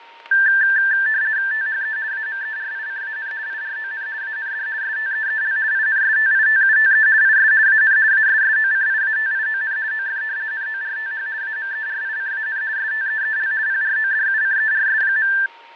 RTTY (50 baud, 170 Hz shift), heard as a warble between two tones, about 1650 Hz centre, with fading, static crashes and a steady whistle near 930 Hz. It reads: THE AMERICAN IRON AND STEEL INSTITUTE IS AN ASSOCIATION OF NORTH AMERICAN STEEL PRODUCERS.